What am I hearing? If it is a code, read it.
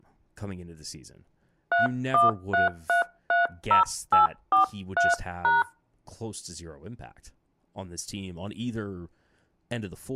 DTMF, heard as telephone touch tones, dialled by hand, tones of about 140 ms, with speech in English. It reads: 313330843#